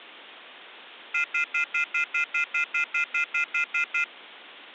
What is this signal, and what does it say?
Telephone call progress tone (North American plan), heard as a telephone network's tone, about 1400, 2050, 2450, 2600 Hz, 0.1 s on and 0.1 s off. Off-hook warning tone.